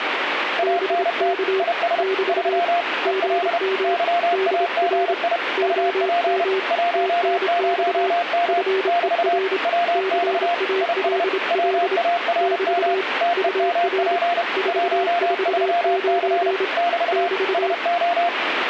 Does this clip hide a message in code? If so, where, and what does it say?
Yes: Morse code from 0.5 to 18.3 s, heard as two keyed tones, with radio static. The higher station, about 31 wpm, 690 Hz: ANT IS 3 EL YAGI UP 10M <BT> WX IS WARM TEMP 13C <BT> SO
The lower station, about 27 wpm, 380 Hz: BK <BT> GM DR OM TNX FER CALL <BT> UR 449 <BT>